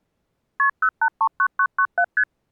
Multi-frequency trunk signalling (R1, as on North American trunks), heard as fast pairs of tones, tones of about 70 ms. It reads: KP 0839997 ST